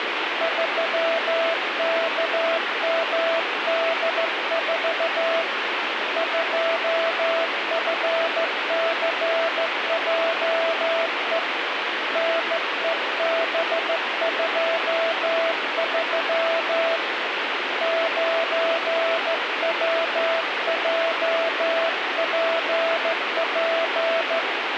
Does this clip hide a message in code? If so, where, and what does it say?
Yes: Morse code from 0.4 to 24.5 s, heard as a keyed tone, hand-sent with a straight key, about 14 wpm, 660 Hz, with radio static. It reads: 3KMD4 2FCJE NEB23 9WJPP